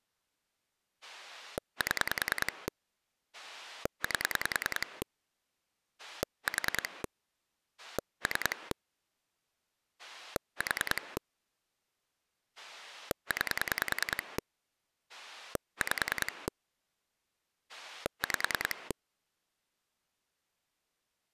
Pulse dialling, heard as a rotary dial, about 10 pulses a second. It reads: 7 8 4 3 4 9 5 5